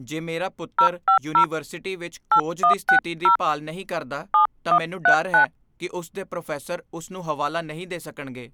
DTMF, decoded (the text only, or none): 050 8160 7139